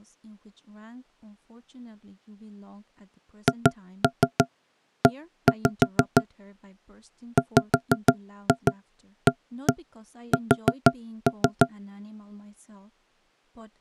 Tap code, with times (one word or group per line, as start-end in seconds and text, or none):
3.5-6.2 HE
7.4-11.7 WAS